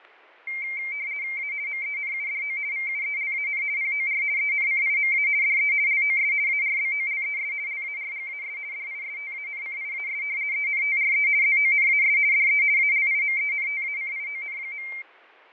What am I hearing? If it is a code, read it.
RTTY (50 baud, 170 Hz shift), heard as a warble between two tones, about 2200 Hz centre, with fading and static crashes. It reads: A MENUDO VUELAN POR ENCIMA DE LOS ARBOLES LARGAS DISTANCIAS ENTRE ZONAS DE ALIMENTACION.